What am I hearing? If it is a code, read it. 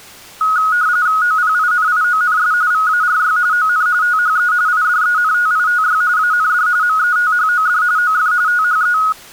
RTTY (45.45 baud, 170 Hz shift), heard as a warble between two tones, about 1360 Hz centre. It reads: OPINIONS VARY ON THE IDENTITY AND METHOD OF THE